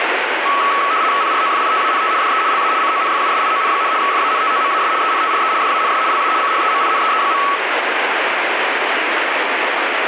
RTTY (75 baud, 170 Hz shift), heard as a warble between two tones, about 1210 Hz centre, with radio static. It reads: PROFITANT DE LA CONFUSION, FANTOMAS ENTRE DANS LA CHEMINEE.